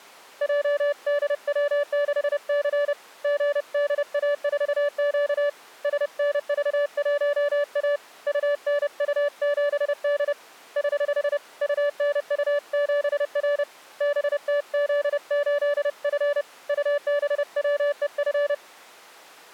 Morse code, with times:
0.4-2.9 JDW6C
3.2-5.5 GDA4Q
5.8-8.0 SNV1A
8.3-10.3 UNU7D
10.8-11.4 <HH>
11.6-13.6 UNU7R
14.0-16.4 BTZ8F
16.7-18.5 UBWEF

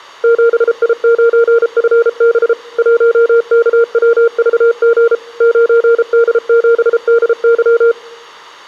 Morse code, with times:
0.2-2.5 7I9FB
2.8-5.1 1KWVG
5.4-7.9 9D7DY

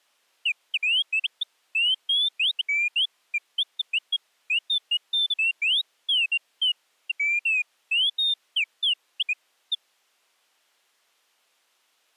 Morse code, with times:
none

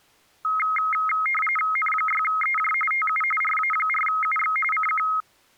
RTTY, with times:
1.8-2.7 N6EJ
2.9-3.2 TU
3.4-4.6 RA4UX
4.7-5.1 CQ

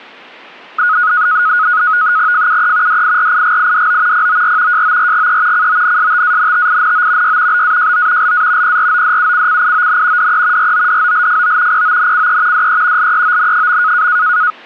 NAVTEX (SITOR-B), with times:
2.3-3.0 FUE
2.9-4.3 DIRIGIDO
4.1-4.8 POR
4.7-5.7 JORGE
5.5-7.4 CONSTANTINO
7.2-7.6 Y
7.5-8.3 BAJO
8.2-8.8 LA
8.6-10.3 PRODUCCION
10.2-10.7 DE
10.6-11.8 RODOLFO
11.7-12.7 PONCE
12.5-13.1 DE
13.0-14.1 LEON.

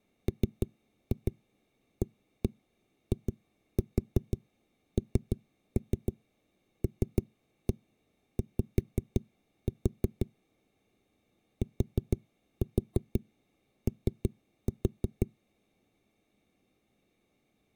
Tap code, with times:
0.3-10.3 MAINLY
11.6-15.3 TO

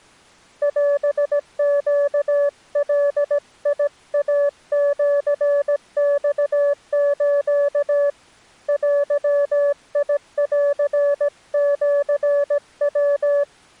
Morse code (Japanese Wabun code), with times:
0.6-8.1 オネガイシマス
8.7-13.4 デンシヤ

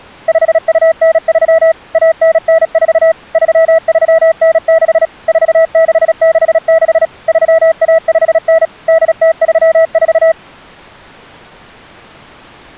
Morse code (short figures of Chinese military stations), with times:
0.3-1.7 5293
1.9-3.1 1994
3.3-5.0 3396
5.3-7.0 4666
7.3-8.6 3159
8.9-10.3 8034

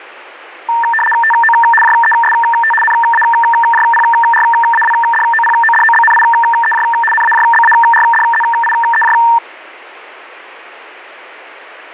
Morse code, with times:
none

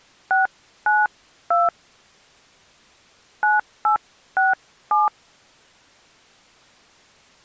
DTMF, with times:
0.3-1.7 692
3.4-5.1 9867

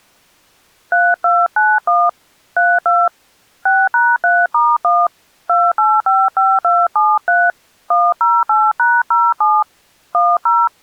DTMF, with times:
0.9-2.1 3291
2.6-3.1 32
3.7-5.1 6#3*1
5.5-7.5 2855273
7.9-9.6 108#07
10.1-10.7 10

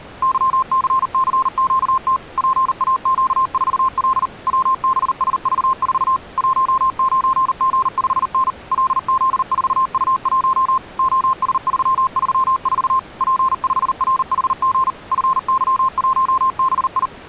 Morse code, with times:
0.2-2.2 YCCQT
2.4-4.3 PAQ4L
4.5-6.2 WBSV4
6.4-8.5 19G5N
8.7-10.8 LZ4U1
11.0-13.0 OS334
13.2-14.9 P5RHG
15.1-17.1 FY1BI

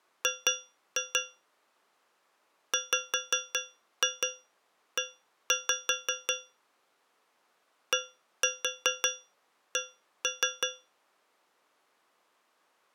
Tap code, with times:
0.2-1.2 G
2.7-6.3 WE
7.9-10.7 DC

